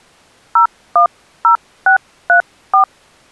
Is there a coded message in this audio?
Yes: DTMF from 0.6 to 2.8 s, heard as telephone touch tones, dialled by hand, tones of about 100 ms. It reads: 010634